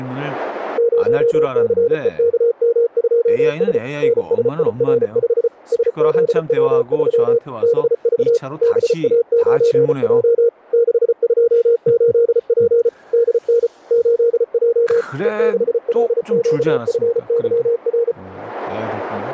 Morse code, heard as a keyed tone, machine-sent, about 34 wpm, 470 Hz, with speech in Korean. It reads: 0CEKM2S NSIR5 SZW3 BV BA9J 628P DN 8J E6LQFYR